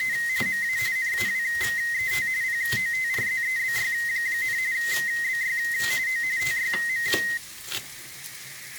RTTY (45.45 baud, 170 Hz shift), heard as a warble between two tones, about 1950 Hz centre, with kitchen noise. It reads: … MA NAWET POTRZEBY, BY O TYM